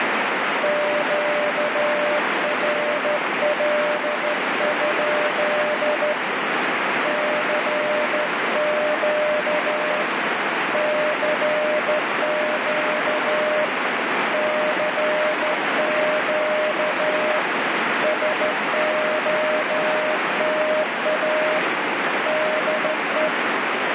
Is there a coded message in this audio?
Yes: Morse code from 0.6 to 23.3 s, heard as a keyed tone, hand-sent with a straight key, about 13 wpm, 610 Hz, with heavy radio static. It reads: QRL? CQ CQ CQ SOTA DE